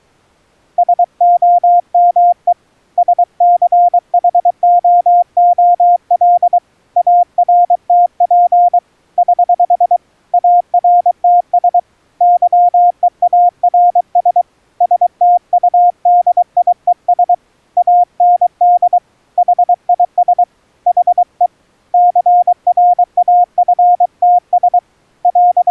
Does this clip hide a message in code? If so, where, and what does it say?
Yes: Morse code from 0.7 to 25.7 s, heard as a keyed tone, hand-sent with a paddle, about 23 wpm, 710 Hz. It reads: SOME SCHOOL ARTP <HH> ARTS YEARS STUDIES AND HIS HE CRAFTS …